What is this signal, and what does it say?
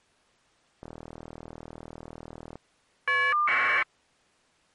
Caller ID data burst, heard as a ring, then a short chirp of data, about 1200 baud.